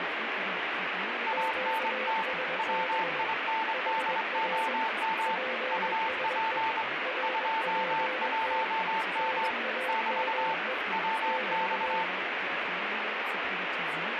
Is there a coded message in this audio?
Yes: Morse code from 1.2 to 12.1 s, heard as two keyed tones, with radio static and speech in German. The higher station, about 23 wpm, 890 Hz: ANT WINDOM UP 21M <BT> WX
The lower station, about 21 wpm, 520 Hz: QSB HR PSE RPT NAME <BT>